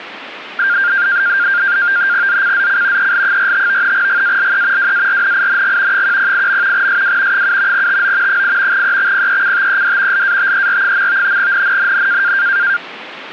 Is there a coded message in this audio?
Yes: NAVTEX (SITOR-B), 100 baud, 170 Hz shift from 0.6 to 12.8 s, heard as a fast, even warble, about 1500 Hz centre. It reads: ZCZC EL45 GALE WARNING 108. SW 7 TO 8 EXPECTED LATER. NNNN